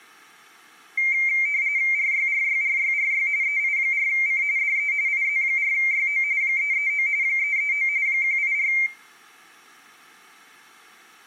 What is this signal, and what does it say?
RTTY (45.45 baud, 170 Hz shift), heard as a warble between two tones, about 2200 Hz centre, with room echo. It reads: RYRYRYRY EI4C DE IZ4YO 339 339 184